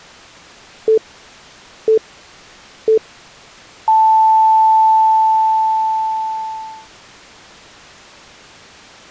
Radio time signal (three low pips and a long one an octave up, as on NHK), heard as pips.